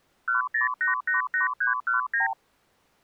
Multi-frequency trunk signalling (R2, with the far end's replies), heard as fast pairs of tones, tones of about 130 ms. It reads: 10888319